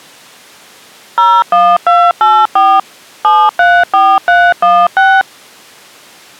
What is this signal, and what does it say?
DTMF, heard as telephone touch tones, dialled by machine, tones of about 240 ms. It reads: 01284 734316